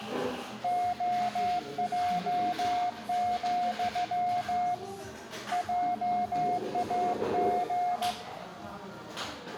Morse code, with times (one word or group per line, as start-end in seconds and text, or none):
0.6-4.7 OJ,
5.5-8.1 JAG